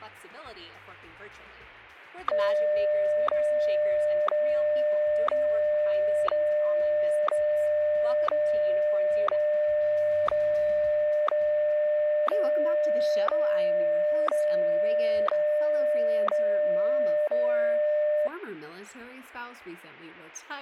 Radio time signal (WWVH, Hawaii), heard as ticks, one a second.